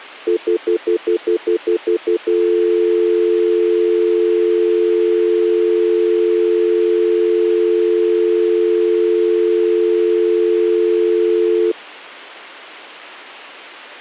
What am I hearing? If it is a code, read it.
Telephone call progress tone (North American plan), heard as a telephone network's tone, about 350, 440 Hz, 0.1 s on and 0.1 s off. Stutter dial tone.